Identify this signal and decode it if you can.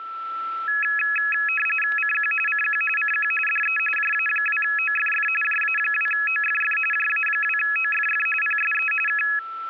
RTTY (45.45 baud, 850 Hz shift), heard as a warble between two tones, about 2100 Hz centre, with static crashes and a steady whistle near 1330 Hz. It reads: CQ CQ CQ DE JA2OFF JA2OFF JA2OFF PSE K